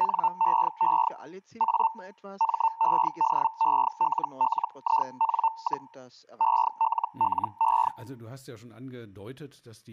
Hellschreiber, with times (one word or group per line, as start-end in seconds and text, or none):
0.0-1.1 NEE
1.6-1.9 A
2.4-5.9 MEDELLIN,
6.4-7.9 ELLE